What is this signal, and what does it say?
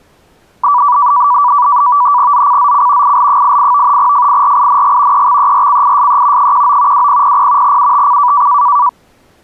NAVTEX (SITOR-B), 100 baud, 170 Hz shift, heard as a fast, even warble, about 1070 Hz centre. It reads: ZCZC IL88 FIRING EXERCISE 19 2000 UTC